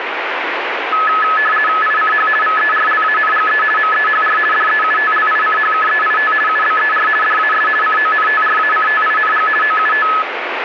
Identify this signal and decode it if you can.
RTTY (50 baud, 450 Hz shift), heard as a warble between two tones, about 1500 Hz centre, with radio static. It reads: ICH VERLANGE MEHR DEUTLICHKEIT UBER DAS CONTRACTING OUT